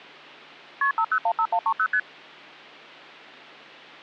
Multi-frequency trunk signalling (R1, as on North American trunks), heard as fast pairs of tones, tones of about 70 ms. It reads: KP 5015130 ST